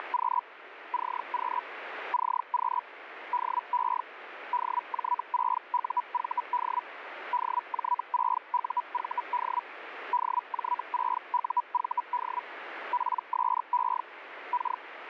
Hellschreiber (Feld-Hell, 122.5 baud), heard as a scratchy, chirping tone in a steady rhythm, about 980 Hz, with radio static. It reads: … CQ CQ DE DJ6UVD DJ6UVD DJ6UVD PSE K